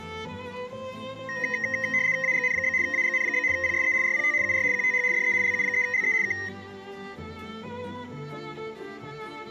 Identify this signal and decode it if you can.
RTTY (75 baud, 170 Hz shift), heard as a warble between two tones, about 1950 Hz centre, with room echo. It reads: AGN? AGN? PSE RPT UR QTH DE LU3LE K